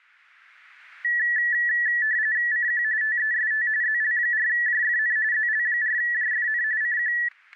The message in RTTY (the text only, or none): CQ TEST ZL4JFN ZL4JFN CQ